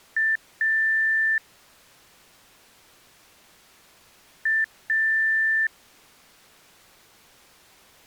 Beep code, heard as beeps, played twice, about 1800 Hz. 1 short, 1 long.